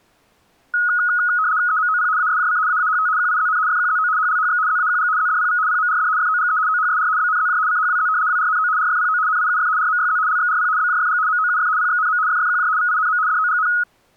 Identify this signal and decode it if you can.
RTTY (75 baud, 170 Hz shift), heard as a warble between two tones, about 1360 Hz centre. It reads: EMOP ASJC AAHT QIZN FQZO HLHX ZAQG ZDPV PMRD FOGE OHSR BNZJ CHWZ WRNO RFPO NIUF RMYZ LXRP BJFG MOUF PXNM FFQJ VINM DOGN